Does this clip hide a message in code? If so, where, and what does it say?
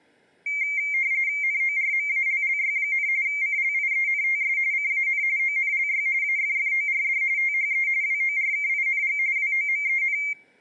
Yes: RTTY (45.45 baud, 170 Hz shift) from 0.5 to 10.3 s, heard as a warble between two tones, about 2200 Hz centre. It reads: NORMALLY, CLIENTS CAN ONLY AFFORD THE WORKING WOMEN